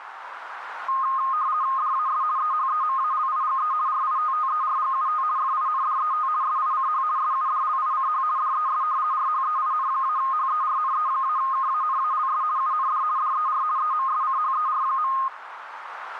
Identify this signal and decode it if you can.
RTTY (50 baud, 170 Hz shift), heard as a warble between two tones, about 1150 Hz centre, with radio static and a narrow filter. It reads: DAS EHEMALIGE RITTERGUT FINDET SICH SUDLICH DES RHEIN-HERNE-KANALS UND DER EMSCHER.